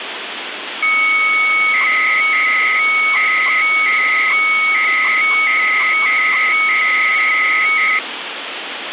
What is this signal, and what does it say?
300-baud modem data (Bell 103 tones), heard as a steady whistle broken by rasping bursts, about 300 baud, 200 Hz shift, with phone line noise.